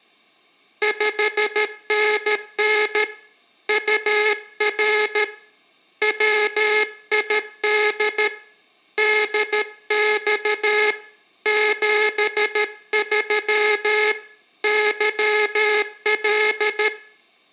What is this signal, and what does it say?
Morse code, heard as a buzzer, hand-sent with a paddle, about 13 wpm, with room echo. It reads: 5NN UR WID DX 73 YL